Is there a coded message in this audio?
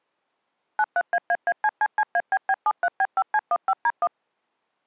Yes: DTMF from 0.8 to 4.1 s, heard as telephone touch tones, dialled by machine, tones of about 50 ms. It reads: 93AAACCCABB73B5C15D1